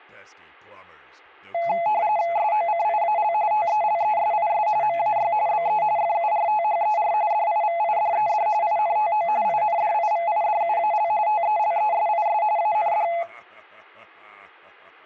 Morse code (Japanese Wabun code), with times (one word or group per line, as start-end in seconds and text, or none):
none